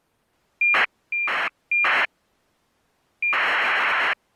ACARS aircraft data, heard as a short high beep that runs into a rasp, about 2400 baud.